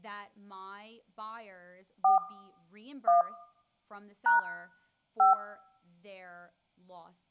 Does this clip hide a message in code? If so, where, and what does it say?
Yes: DTMF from 2.0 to 5.3 s, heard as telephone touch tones, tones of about 140 ms, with room echo and speech in English. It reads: 4 1 # 5